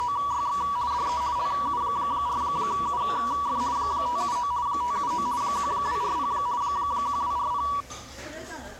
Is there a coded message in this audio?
Yes: RTTY (50 baud, 170 Hz shift) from 0.0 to 7.8 s, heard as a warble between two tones, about 1060 Hz centre, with the noise of a crowd indoors. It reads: … DE LU4UF 579 579 1240 1240